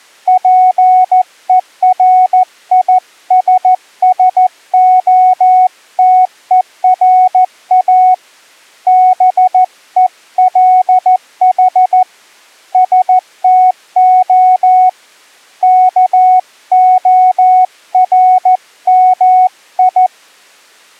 Morse code (Greek alphabet), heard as a keyed tone, hand-sent with a paddle, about 14 wpm, 740 Hz. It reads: ΠΕΡΙΣΣΟΤΕΡΑ ΒΕΛΗ ΣΤΟ ΚΟΡΜΙ